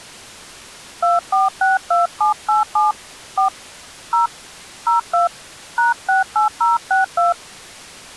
DTMF, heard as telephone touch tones, dialled by hand, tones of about 140 ms. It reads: 2462787 4 0 02 #68062